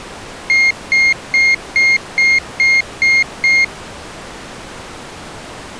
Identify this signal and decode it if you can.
Beep code, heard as a piezo beeper, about 2150 Hz. 8 short. In AMI BIOS tables: display memory failure; in Dell tables: LCD failure.